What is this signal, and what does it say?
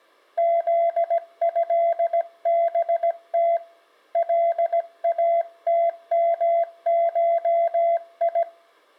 Morse code (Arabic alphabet), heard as a keyed tone, hand-sent with a paddle, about 17 wpm, 680 Hz. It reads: ذهبت لاتمشي